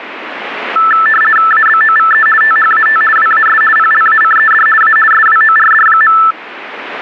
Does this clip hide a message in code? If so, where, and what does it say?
Yes: RTTY (50 baud, 450 Hz shift) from 0.8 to 6.3 s, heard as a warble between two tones, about 1550 Hz centre, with radio static. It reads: ABOVE THAT WAS PLACED A SWORD.